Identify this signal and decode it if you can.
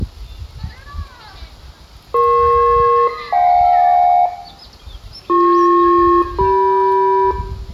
Aircraft SELCAL, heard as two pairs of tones, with room echo and the noise of a park. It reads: EP-JK BP-CM